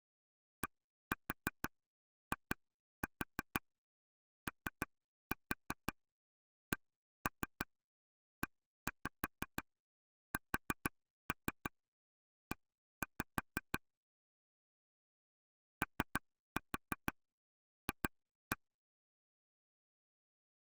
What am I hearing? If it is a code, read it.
Tap code, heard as taps on a table, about 6 knocks a second. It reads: DIOCESE OF